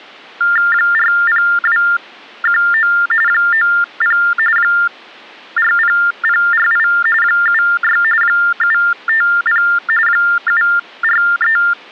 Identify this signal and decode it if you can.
TTY/TDD text telephone tones (45.45 baud Baudot), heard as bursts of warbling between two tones, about 400 Hz shift, 1600 Hz centre. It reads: 40219 90 40048 76 750 743